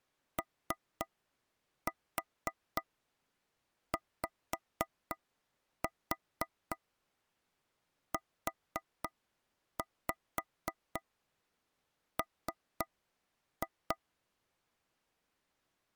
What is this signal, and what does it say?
Tap code, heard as taps on a table, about 3 knocks a second. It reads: OYUM